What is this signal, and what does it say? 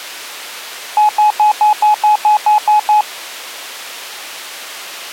Beep code, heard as beeps, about 850 Hz. 10 short. In AMI BIOS tables: CMOS shutdown register error.